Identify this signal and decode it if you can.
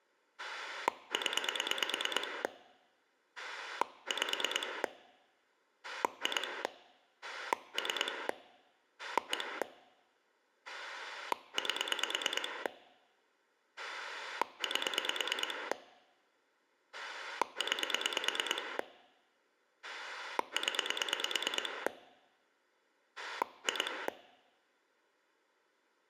Pulse dialling, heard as a rotary dial, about 9 pulses a second. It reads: 0 5 2 3 1 8 8 9 0 2